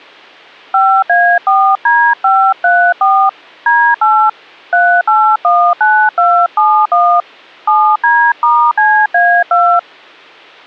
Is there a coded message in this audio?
Yes: DTMF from 0.7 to 9.8 s, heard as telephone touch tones, dialled by hand, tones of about 290 ms. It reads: 5A4D534 D8 3819271 7D*CA2